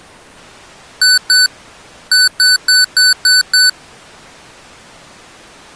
Beep code, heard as beeps from a small speaker, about 1500 Hz. 2-6.